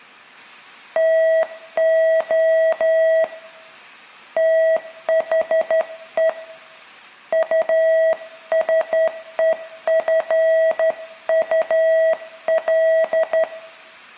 Morse code, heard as a keyed tone, hand-sent with a straight key, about 12 wpm, 650 Hz, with room echo. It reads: TO THE USEFUL